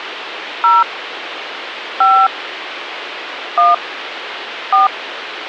DTMF, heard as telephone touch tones, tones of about 200 ms, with phone line noise. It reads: 0 5 1 4